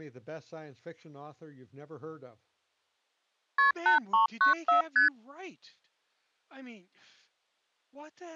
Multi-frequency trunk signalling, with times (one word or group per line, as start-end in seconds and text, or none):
3.6-3.7 KP
3.9-4.8 8394
5.0-5.1 ST